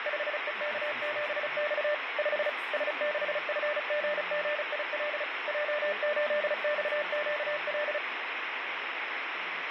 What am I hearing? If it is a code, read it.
Morse code, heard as a keyed tone, machine-sent, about 35 wpm, 600 Hz, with radio static and speech in English. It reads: 5EK7X 5 S6FGGIL J8XQL